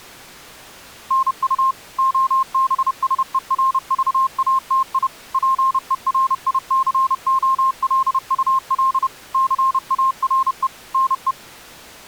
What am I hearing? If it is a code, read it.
Morse code, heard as a keyed tone, machine-sent, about 30 wpm, 1060 Hz. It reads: NU OBSERVATI PERICOLUL CARE NE